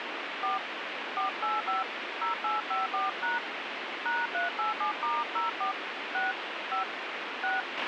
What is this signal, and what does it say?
DTMF, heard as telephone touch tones, dialled by hand, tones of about 160 ms, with radio hiss and a squelch burst at the end. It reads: 4 485 0854# #387*04 6 5 6